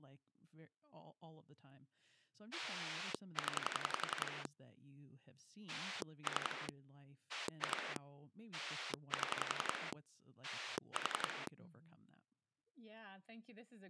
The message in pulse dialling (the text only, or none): 0 3 2 7 4